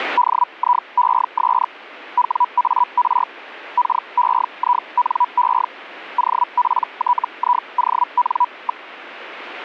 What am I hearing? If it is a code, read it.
Hellschreiber (Feld-Hell, 122.5 baud), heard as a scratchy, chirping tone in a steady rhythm, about 980 Hz. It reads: DIES WAR KEINE OPTION.